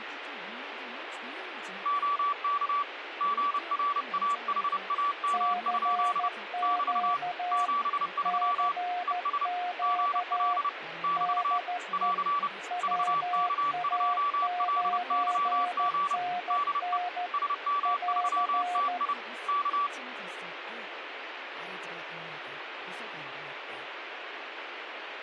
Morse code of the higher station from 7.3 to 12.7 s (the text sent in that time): 73 ES GL <BT> <AR>